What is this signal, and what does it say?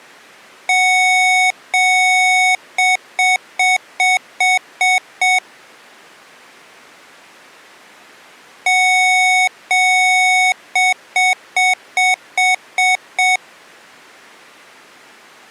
Beep code, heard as beeps from a small speaker, played twice, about 740 Hz. 2 long, 7 short.